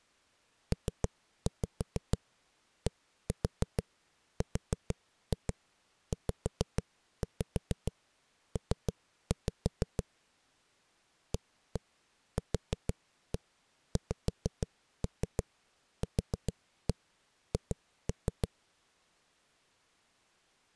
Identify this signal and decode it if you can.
Tap code, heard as knocks on a wall, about 6 knocks a second. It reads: PDRZP AQXQH